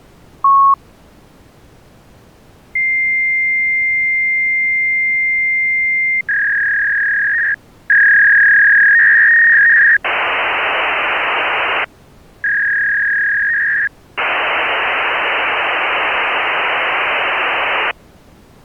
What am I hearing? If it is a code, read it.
Fax machine handshake, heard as a long tone, a warble and hiss.